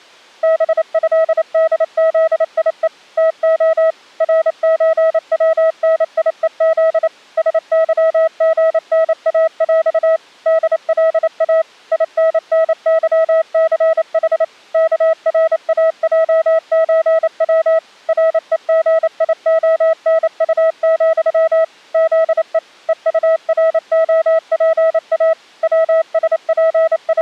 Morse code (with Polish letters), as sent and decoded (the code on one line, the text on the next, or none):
-... ..-.. -.. --.. .. . / - --- / .-. ---. .-- -. .. . --.. / ... -.-- --. -. .- .-..- / -.. .-.. .- / .. -. -. -.-- -.-. .... / -.- .-. .- .--- ---. .-- / .-. . --. .. --- -. ..- --..-- / --.. . / . ..- .-. --- .--. .- / …
BĘDZIE TO RÓWNIEZ SYGNAŁ DLA INNYCH KRAJÓW REGIONU, ZE EUROPA …